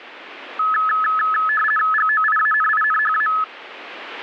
RTTY (50 baud, 450 Hz shift), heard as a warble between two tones, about 1500 Hz centre, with radio static. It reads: GOIANINHA